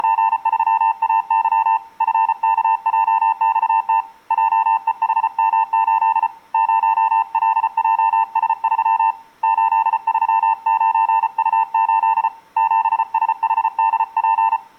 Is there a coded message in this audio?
Yes: Morse code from 0.0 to 14.6 s, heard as a keyed tone, hand-sent with a paddle, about 34 wpm, 900 Hz. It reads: … FKJXT JEHM8 0LJS3 839U8 7SHDP